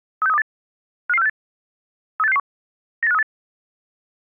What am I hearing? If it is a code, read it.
Five-tone selective call (EEA), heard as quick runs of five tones, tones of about 40 ms. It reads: 36328 55468 38661 98538